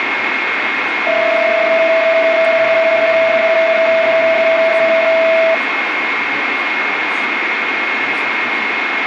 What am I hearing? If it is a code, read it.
PSK31 (31.25 baud), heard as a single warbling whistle, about 650 Hz, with radio static, a steady whistle near 2150 Hz and speech in English.